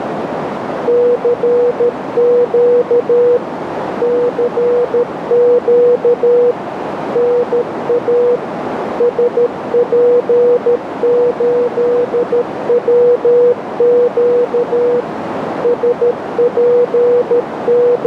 Morse code, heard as a keyed tone, machine-sent, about 13 wpm, 490 Hz, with radio static and a narrow filter. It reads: CQ CQ NA SP8WQ …